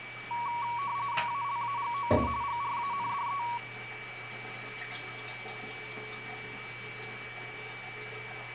RTTY (45.45 baud, 170 Hz shift), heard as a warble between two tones, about 1040 Hz centre, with radio static, a steady whistle near 2300 Hz and the noise of a restroom. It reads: ALAGOA GRANDE